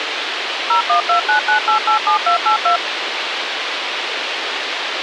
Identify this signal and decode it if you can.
DTMF, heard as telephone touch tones, dialled by machine, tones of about 110 ms, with radio hiss. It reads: 01299887282